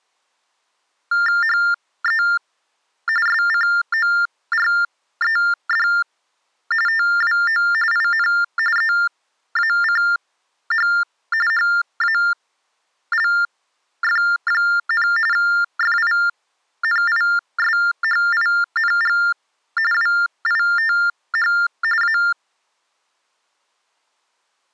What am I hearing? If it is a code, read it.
TTY/TDD text telephone tones (45.45 baud Baudot), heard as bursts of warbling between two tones, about 400 Hz shift, 1600 Hz centre. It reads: HE SCORED TWO IN EACH HALF, FINISHING WITH A